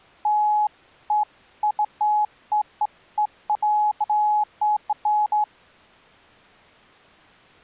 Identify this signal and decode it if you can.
Beeps of irregular length. There is no code.